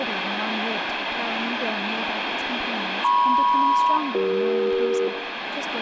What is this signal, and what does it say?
Aircraft SELCAL, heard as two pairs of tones, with radio static, room echo and speech in English. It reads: MP-CE